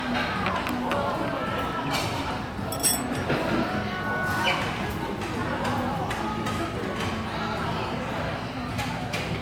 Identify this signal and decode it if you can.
The noise of a restaurant. There is no code.